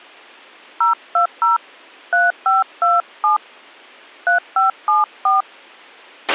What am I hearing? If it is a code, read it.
DTMF, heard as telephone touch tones, dialled by hand, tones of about 140 ms, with a squelch burst at the end. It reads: 020 3527 3574